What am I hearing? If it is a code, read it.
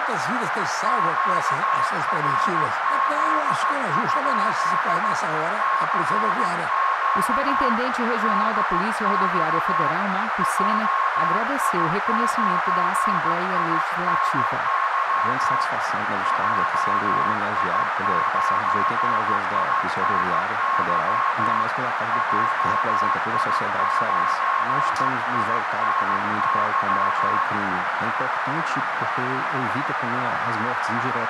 Morse code, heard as a keyed tone, hand-sent with a straight key, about 15 wpm, 1080 Hz, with heavy radio static and a narrow filter. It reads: QRZ? CQ DX JI9INY JI9INY JI9INY